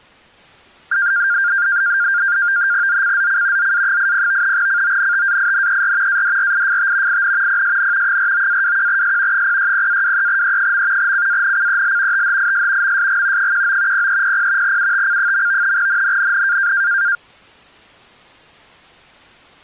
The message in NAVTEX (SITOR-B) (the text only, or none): ZCZC ZA80 CONTAINER ADRIFT IN PSN 49-21S 060-23E. CANCEL THIS MSG 19 0300 UTC. NNNN